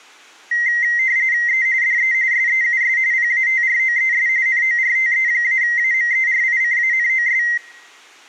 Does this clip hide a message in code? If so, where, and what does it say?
Yes: RTTY (45.45 baud, 170 Hz shift) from 0.5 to 7.6 s, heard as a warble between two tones, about 2000 Hz centre. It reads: E DE SEUS PATROES NORTE-AMERICANOS